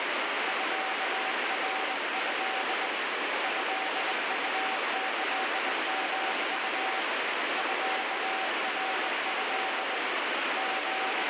Morse code (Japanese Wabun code), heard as a keyed tone, hand-sent with a bug key, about 20 wpm, 760 Hz, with heavy radio static. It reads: ミナト トウキヨウ ミナト …